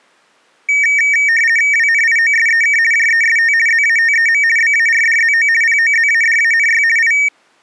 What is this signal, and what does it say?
RTTY (50 baud, 450 Hz shift), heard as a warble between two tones, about 2050 Hz centre. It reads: WNIOSEK JEST ZATEM BARDZO POZADANY I